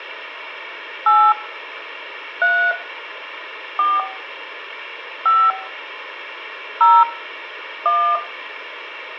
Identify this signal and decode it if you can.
DTMF, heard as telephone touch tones, dialled by hand, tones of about 260 ms, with room echo. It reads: 8 3 4 5 0 1